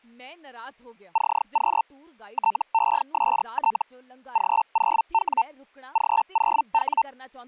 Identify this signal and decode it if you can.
Hellschreiber (Feld-Hell, 122.5 baud), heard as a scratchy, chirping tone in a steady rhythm, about 900 Hz, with speech in Punjabi. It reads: CQ TEST G0W G0W